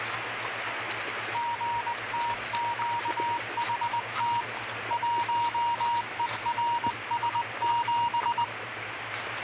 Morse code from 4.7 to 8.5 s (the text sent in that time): 1ERS7